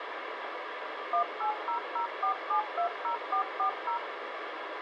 DTMF, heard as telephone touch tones, dialled by machine, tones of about 100 ms, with radio hiss. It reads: 18004720440